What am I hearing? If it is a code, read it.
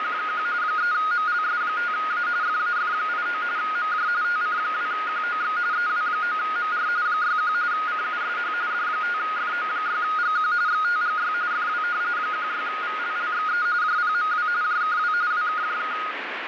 RTTY (45.45 baud, 170 Hz shift), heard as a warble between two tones, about 1340 Hz centre, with radio static. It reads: … 3MLS5A FAF89 MJ TC2QOX EW9MR 61 CUSH D5FO6GQ XTGY FW 16VLLXE JPMW JKW WKJK